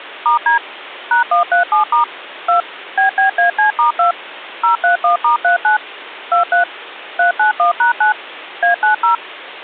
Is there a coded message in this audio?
Yes: DTMF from 0.3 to 9.2 s, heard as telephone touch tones, dialled by machine, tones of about 120 ms. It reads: *D #137* 2 BBAC*2 031*39 23 391#9 A90